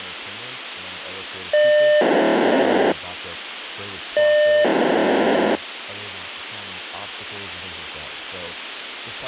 POCSAG pager data (1200 baud), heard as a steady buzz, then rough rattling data, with radio hiss, a squelch burst at the end and speech in English.